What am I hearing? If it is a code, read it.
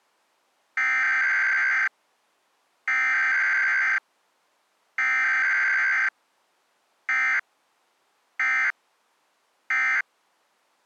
Emergency Alert System (SAME) tones (header bursts, then end-of-message bursts), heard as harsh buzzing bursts, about 520.83 baud.